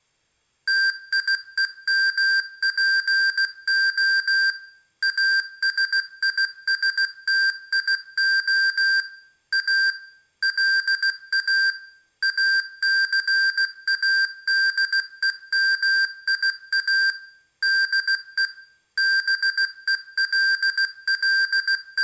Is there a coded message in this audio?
Yes: Morse code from 0.6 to 22.0 s, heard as electronic beeps, machine-sent, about 16 wpm, 1600 Hz, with room echo. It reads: TIEMPO ASISTIO A LA ACADEMIA DE …